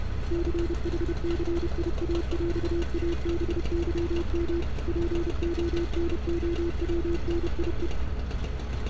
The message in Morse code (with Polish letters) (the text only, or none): CHCIAŁABYM PONOWNIE